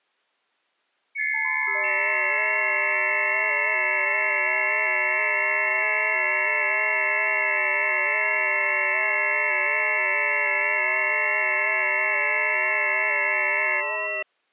FT8 (several signals at once), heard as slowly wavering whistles, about 6.25 baud.